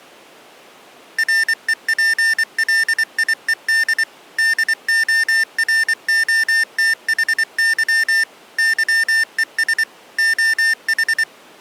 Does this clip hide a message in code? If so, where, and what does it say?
Yes: Morse code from 1.1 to 11.3 s, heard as electronic beeps, machine-sent, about 24 wpm, 1800 Hz. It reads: REPLIED DOROTHY YES OH